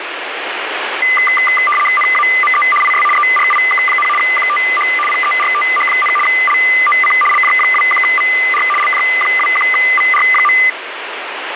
RTTY (75 baud, 850 Hz shift), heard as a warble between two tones, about 1600 Hz centre, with radio static. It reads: NAME IS ERIK, QTH PERTH, LOC LJ21VR LJ21VR.